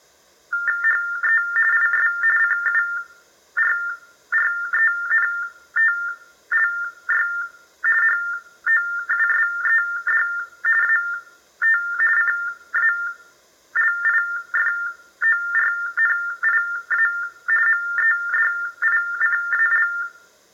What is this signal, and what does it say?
TTY/TDD text telephone tones (45.45 baud Baudot), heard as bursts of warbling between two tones, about 400 Hz shift, 1600 Hz centre, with room echo. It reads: HE IS CURRENTLY HOUSED AT CALIFORNIA MEDICAL